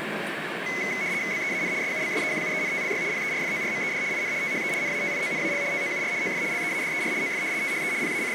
RTTY (75 baud, 170 Hz shift), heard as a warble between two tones, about 2100 Hz centre, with radio static and the noise inside a subway train. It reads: BEAN SUBSEQUENTLY PERFORMED IN THE NATIONAL TOUR OF LEADER OF THE …